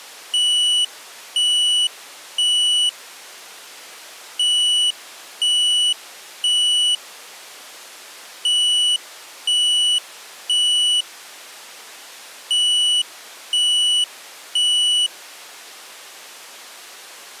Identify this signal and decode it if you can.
Alarm pattern, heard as an alarm's beeps, played four times, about 2950 Hz. Temporal three. Smoke or fire, evacuate.